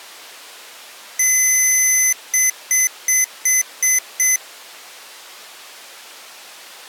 Beep code, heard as beeps from a small speaker, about 2050 Hz. 1 long, 6 short.